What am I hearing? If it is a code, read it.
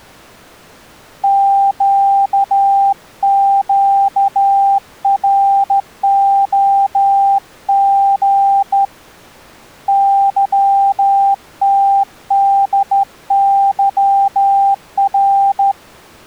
Morse code, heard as a keyed tone, hand-sent with a straight key, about 13 wpm, 790 Hz. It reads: QQROG YTDYR